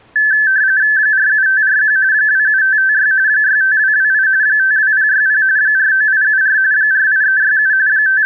RTTY (45.45 baud, 170 Hz shift), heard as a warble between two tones, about 1650 Hz centre. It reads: 47541 27556 65228 52060 49874 48367 …